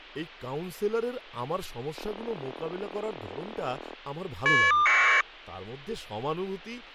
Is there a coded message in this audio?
Yes: caller ID data burst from 2.0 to 5.2 s, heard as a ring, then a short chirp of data, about 1200 baud, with speech in Bangla.